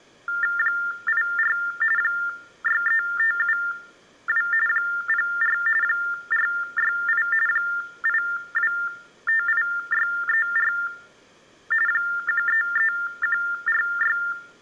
TTY/TDD text telephone tones (45.45 baud Baudot), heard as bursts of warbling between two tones, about 400 Hz shift, 1600 Hz centre. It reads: 84 63572 04 468 8258634 133146